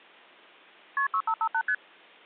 Multi-frequency trunk signalling (R1, as on North American trunks), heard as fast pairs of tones, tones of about 70 ms. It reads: KP 6558 ST